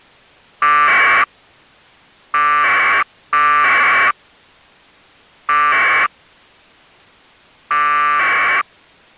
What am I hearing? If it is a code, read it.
Packet radio (AX.25, as in APRS), 1200 baud, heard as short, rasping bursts.